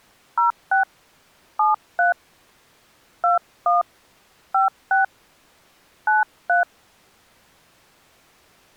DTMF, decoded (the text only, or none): 06 73 21 56 93